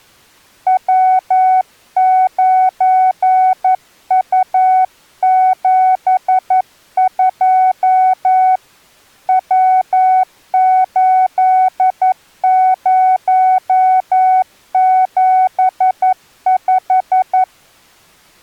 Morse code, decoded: W9U72 W8075

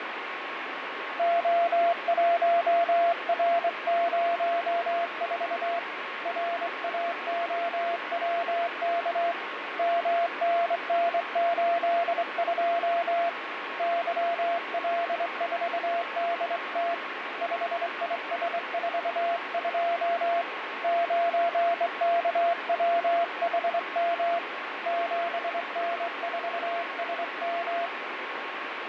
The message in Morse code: O1R04 RAOWK MNN82 YL4DT 5IS42 9KWHM 7N4SM

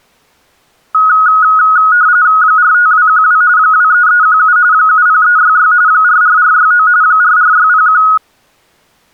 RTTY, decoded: 45212 23317 70366 44469 44601

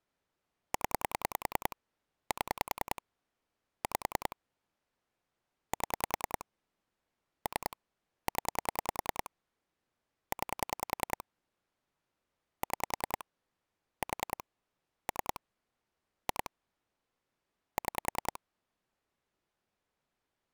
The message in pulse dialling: 0 7 5 7 3 0 9 6 4 3 2 6

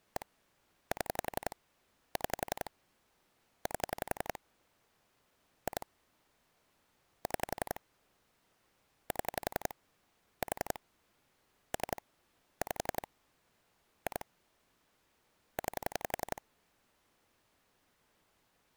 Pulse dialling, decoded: 1 7 6 8 2 6 7 4 3 5 2 9

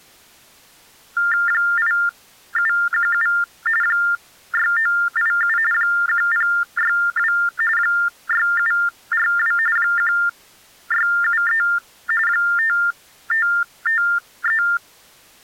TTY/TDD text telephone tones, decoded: 8717 6987 1062 6742 1673 5553

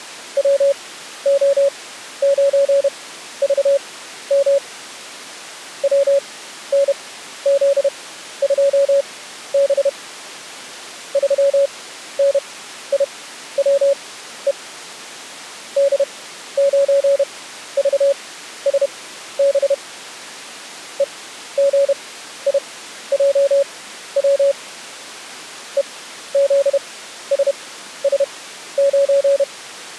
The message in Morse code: WO9VM WNZ2B 3NIWE D9VSB EGIJW EZSS9

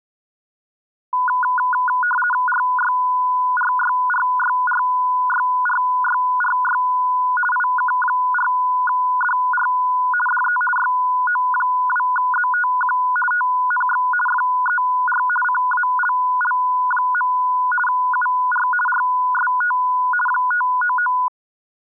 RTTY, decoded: RYRYRYRYRYRY IK4DR DE YO2ZTQ TNX FER CALL. UR RST 599

